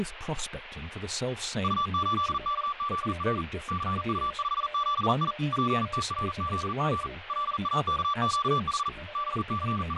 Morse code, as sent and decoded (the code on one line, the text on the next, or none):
..- ---.. -.- --.. .-. / -.-. ..- ..... --... .. / .--. - .-. --.. --. / .-.. .- -.- --.- .... / …
U8KZR CU57I PTRZG LAKQH …